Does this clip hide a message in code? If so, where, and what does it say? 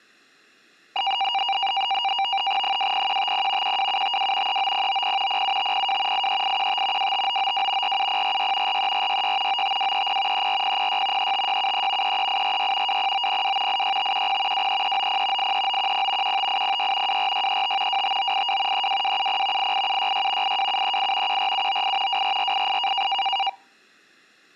Yes: NAVTEX (SITOR-B), 100 baud, 170 Hz shift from 1.0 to 23.5 s, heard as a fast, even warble, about 870 Hz centre. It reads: 20150 12752 39090 07502 83815 25992 47046 43466 95230 34006 35673 33846 20902 86510 23390 83910 15806 24635 25982 32270 88766 82738 14798 24488